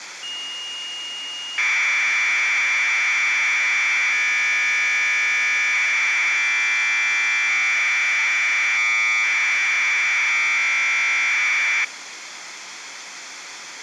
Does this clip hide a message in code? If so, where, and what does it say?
Yes: Commodore tape loading (standard loader) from 0.2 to 11.8 s, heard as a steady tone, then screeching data, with tape hiss.